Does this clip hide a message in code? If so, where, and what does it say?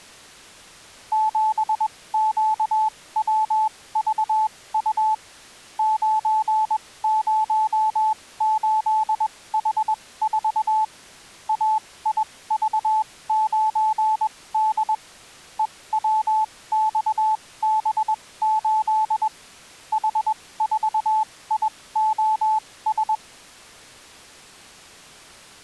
Yes: Morse code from 1.1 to 23.2 s, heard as a keyed tone, machine-sent, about 21 wpm, spaced as for 17 wpm, 870 Hz. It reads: 7QWVU 908H4 AIV9D EWXB8 H4IOS